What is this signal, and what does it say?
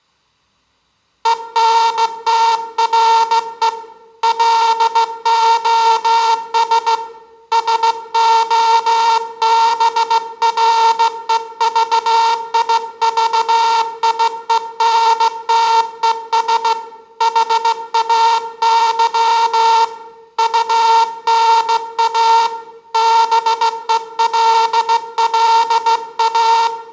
Morse code, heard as a buzzer, hand-sent with a straight key, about 16 wpm, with room echo. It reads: ENTRE LOS SOBREVIVIENTES HAY UNA BELLA